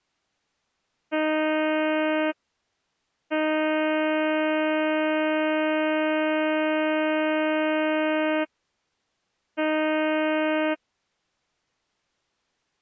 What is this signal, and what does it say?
Ship horn signal, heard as a ship's horn, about 310 Hz. 1 short, 1 long, 1 short. At sea: a vessel at anchor warns of its position.